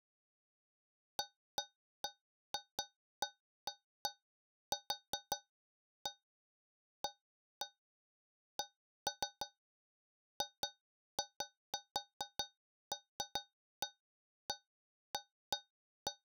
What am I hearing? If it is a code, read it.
Irregular taps on a metal pipe. There is no code.